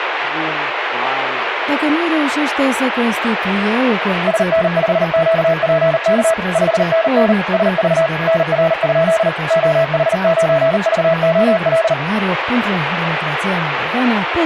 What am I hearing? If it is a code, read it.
Morse code, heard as a keyed tone, machine-sent, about 39 wpm, 660 Hz, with radio static and a weaker station near 1660 Hz. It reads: SN5QPK 5NN SV NR? OH9VOL